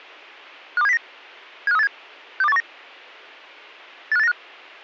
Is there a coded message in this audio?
Yes: five-tone selective call (EEA) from 0.8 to 4.3 s, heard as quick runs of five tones, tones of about 40 ms. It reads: 52709 75387 62819 85895